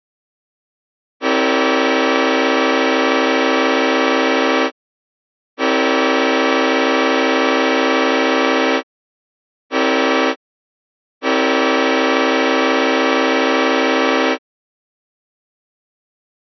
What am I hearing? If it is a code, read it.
Train horn signal, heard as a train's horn. 2 long, 1 short, 1 long. On North American railways: approaching a public crossing.